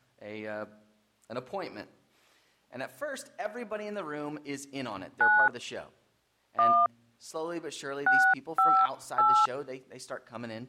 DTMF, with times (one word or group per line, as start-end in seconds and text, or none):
5.2-5.5 9
6.6-6.9 1
8.1-9.5 658